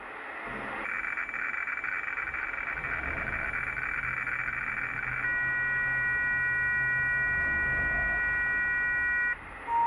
Weather fax (radiofax), 120 lines a minute, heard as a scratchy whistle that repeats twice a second, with radio static and the noise inside a lift.